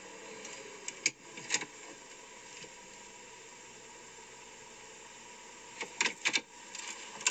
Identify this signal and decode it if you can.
The noise inside a car. There is no code.